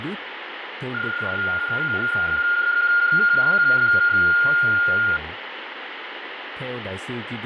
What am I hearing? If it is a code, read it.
PSK31 (31.25 baud), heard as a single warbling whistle, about 1420 Hz, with radio static, fading and speech in Vietnamese.